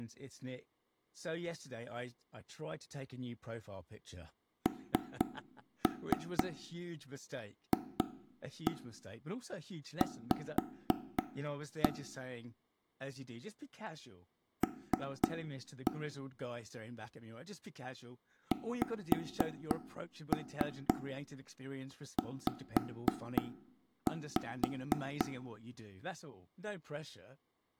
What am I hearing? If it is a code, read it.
Tap code, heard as taps on a table, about 4 knocks a second, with room echo and speech in English. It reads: NFV L XZ